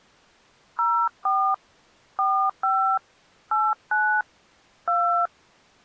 DTMF, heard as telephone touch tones, dialled by hand, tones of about 290 ms. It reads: 04 45 89 2